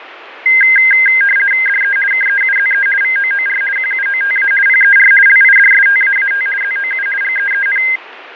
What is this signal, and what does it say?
RTTY (50 baud, 450 Hz shift), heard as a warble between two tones, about 1850 Hz centre, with radio static and fading. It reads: DE KEUZE VOOR QUOTA PER LIDSTAAT ZOU GEEN